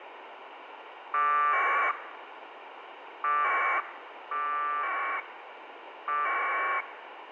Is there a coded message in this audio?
Yes: packet radio (AX.25, as in APRS), 1200 baud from 1.1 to 6.8 s, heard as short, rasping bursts, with radio hiss and a squelch burst at the end.